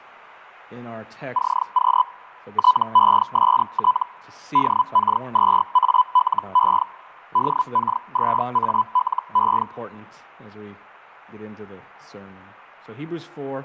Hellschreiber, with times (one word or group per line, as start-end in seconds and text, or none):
1.3-2.0 CQ
2.5-4.0 TEST
4.5-6.8 DK2ALE
7.3-9.6 DK2ALE